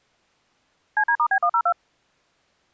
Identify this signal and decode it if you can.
DTMF, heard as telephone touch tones, dialled by machine, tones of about 70 ms. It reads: CD*B102